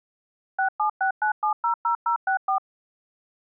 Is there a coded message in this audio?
Yes: DTMF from 0.6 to 2.6 s, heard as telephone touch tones, dialled by machine, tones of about 100 ms. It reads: 6769700064